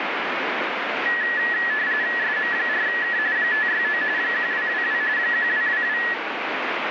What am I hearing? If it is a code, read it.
RTTY (45.45 baud, 170 Hz shift), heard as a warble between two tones, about 1800 Hz centre, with radio static. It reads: SM4K 569 1222 1222